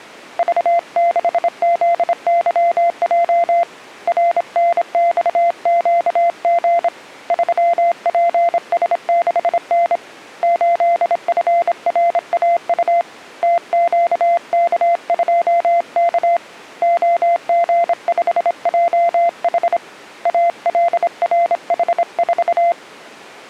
Morse code, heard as a keyed tone, hand-sent with a straight key, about 26 wpm, 690 Hz. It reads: V6ZYJ RNXQG 3PS6N 8FRAU TQK2K OG5JH ALRH4